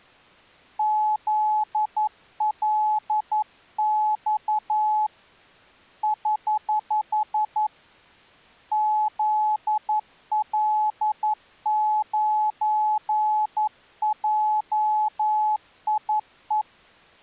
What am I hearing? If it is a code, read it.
Morse code, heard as a keyed tone, hand-sent with a paddle, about 11 wpm, 850 Hz. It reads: ZLX <HH> ZL9JIE